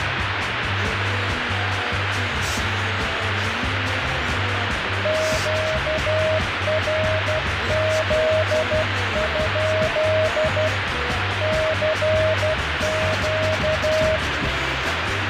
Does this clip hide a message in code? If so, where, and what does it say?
Yes: Morse code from 5.0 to 14.2 s, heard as a keyed tone, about 12 wpm, 630 Hz, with heavy radio static. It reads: QRZ? CQ